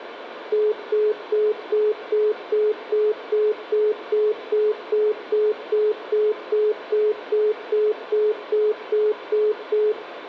Telephone call progress tone (single-tone plan, as in most of Europe), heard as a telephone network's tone, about 420 Hz, 0.2 s on and 0.2 s off, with phone line noise and room echo. Congestion tone.